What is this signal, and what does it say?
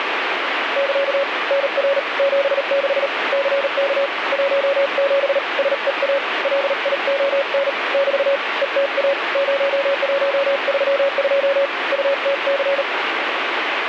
Morse code, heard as a keyed tone, hand-sent with a paddle, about 38 wpm, 560 Hz, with radio static. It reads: <KA> NR 76 CK 17 SEA LION <BT> ETA 0132 UTC